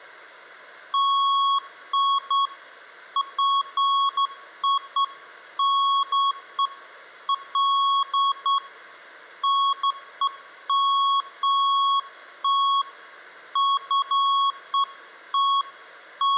Beeps of irregular length, with room echo. There is no code.